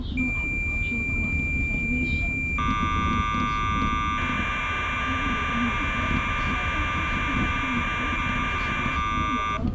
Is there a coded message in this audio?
Yes: cassette data (Kansas City type), 1200 baud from 0.2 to 9.6 s, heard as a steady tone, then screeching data, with the noise inside a bus.